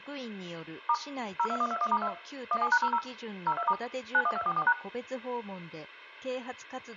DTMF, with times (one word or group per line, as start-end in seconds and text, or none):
0.9-0.9 *
1.4-2.1 02121*2
2.5-3.0 17#00
3.5-3.7 02*
4.1-4.7 91244#